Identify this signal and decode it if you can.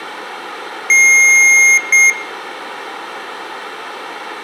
Beep code, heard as beeps from a small speaker, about 2150 Hz, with room echo. 1 long, 1 short. In IBM BIOS tables: system board problem.